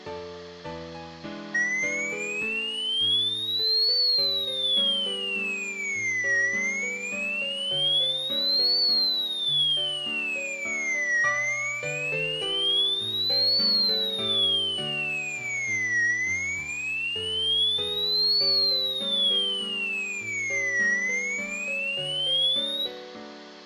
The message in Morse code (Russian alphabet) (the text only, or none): none